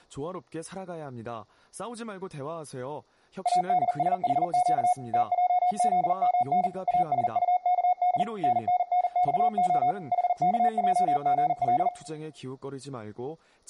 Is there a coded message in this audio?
Yes: Morse code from 3.4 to 11.9 s, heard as a keyed tone, machine-sent, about 40 wpm, 730 Hz, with room echo and speech in Korean. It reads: ADSHQ TJZMN ASUKD NNNXO HKJGL